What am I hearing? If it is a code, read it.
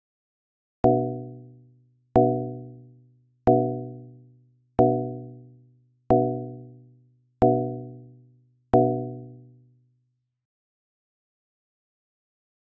Clock strike, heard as a bell. 7. Seven o'clock.